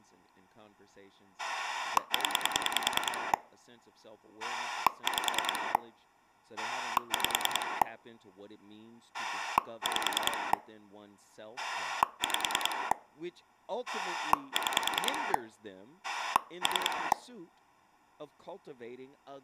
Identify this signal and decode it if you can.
Pulse dialling, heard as a rotary dial, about 10 pulses a second, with speech in English. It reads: 0 5 5 5 5 6 3